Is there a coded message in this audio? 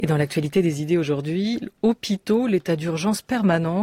No.